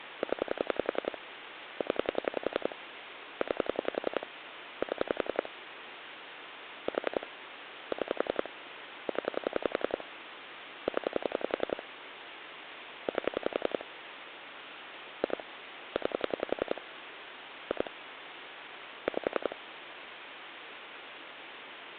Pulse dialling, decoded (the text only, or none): 0 0 9 7 4 6 0 0 8 2 9 2 5